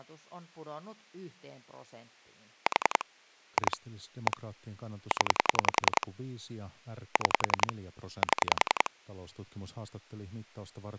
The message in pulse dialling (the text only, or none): 4 2 1 0 6 7